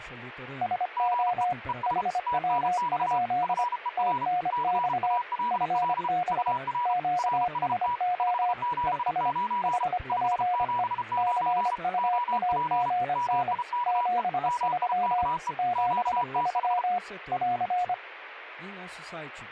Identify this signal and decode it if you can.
Morse code, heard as two keyed tones, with speech in Portuguese. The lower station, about 25 wpm, 720 Hz: SO HW? TNX FB QSO ES HPE CUAGN 73 73 <AR>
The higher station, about 33 wpm, 970 Hz: GE ES TNX FER CALL UR RST 579 579 OP MIKE MIKE QTH